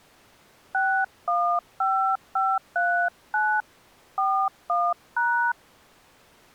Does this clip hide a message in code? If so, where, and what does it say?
Yes: DTMF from 0.7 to 5.5 s, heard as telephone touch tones, dialled by hand, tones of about 290 ms. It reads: 615539 41#